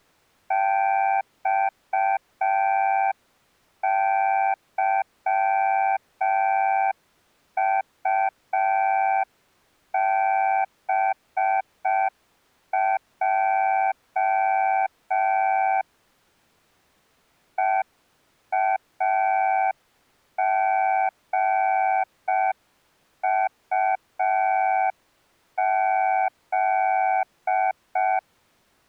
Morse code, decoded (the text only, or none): XYUBJ EAGUZ